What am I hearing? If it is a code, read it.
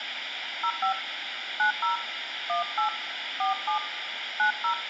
DTMF, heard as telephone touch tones, dialled by hand, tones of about 100 ms, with phone line noise. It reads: 05 90 18 47 90